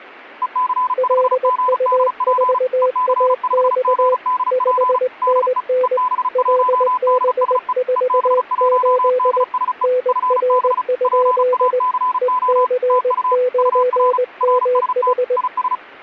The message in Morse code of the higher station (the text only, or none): EC5GDP EC5GDP DE EB1DSE EB1DSE FB PACO TU UR RST IS